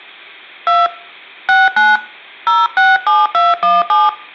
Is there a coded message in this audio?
Yes: DTMF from 0.7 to 4.1 s, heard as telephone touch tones, dialled by hand, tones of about 190 ms, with room echo. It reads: 2 69 067217